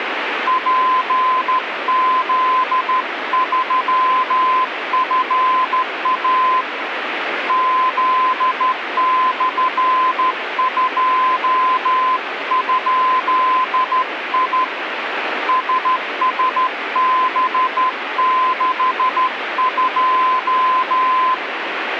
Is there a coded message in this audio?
Yes: Morse code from 0.4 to 21.4 s, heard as a keyed tone, hand-sent with a straight key, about 13 wpm, 1030 Hz, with radio static. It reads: PZ3FA Z/2?I SSB62